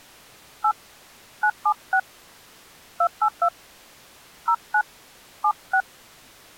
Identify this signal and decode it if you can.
DTMF, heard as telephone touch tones, dialled by hand, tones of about 70 ms. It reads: 8 976 282 09 76